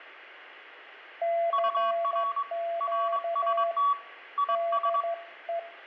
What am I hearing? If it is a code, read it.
Morse code, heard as two keyed tones, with radio static and room echo. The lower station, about 13 wpm, 680 Hz: CQ DE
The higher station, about 22 wpm, 1130 Hz: UR RST IS